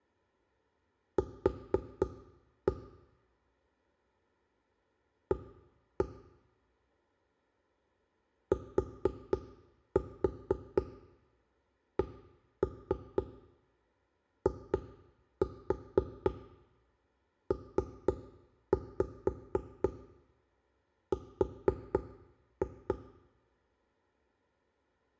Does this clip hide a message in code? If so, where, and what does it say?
Yes: tap code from 1.2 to 23.0 s, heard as knocks on wood, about 4 knocks a second, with room echo. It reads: Q A TCIPR